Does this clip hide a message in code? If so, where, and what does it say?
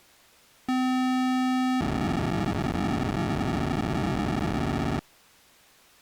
Yes: POCSAG pager data (512 baud) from 0.7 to 5.0 s, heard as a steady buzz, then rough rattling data.